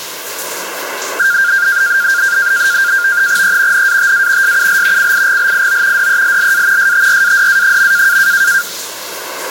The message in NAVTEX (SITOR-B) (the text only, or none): E NATA SUL CIGLIO DELLA STRADA.